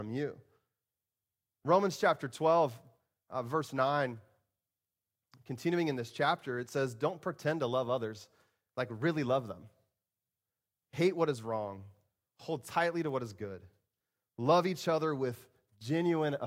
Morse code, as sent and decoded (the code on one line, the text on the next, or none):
none